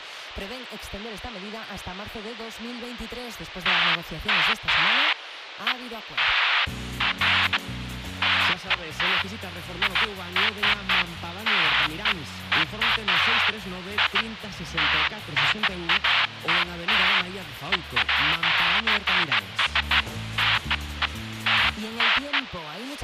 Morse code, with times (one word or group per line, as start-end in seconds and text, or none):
none